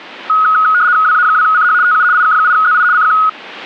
RTTY (75 baud, 170 Hz shift), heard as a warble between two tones, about 1360 Hz centre. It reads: WA2CH TU IK8ZI CQ